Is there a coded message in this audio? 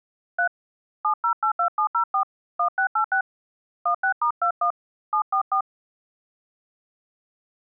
Yes: DTMF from 0.4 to 5.6 s, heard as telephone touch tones, dialled by hand, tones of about 90 ms. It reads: 3 7082704 1686 16*21 744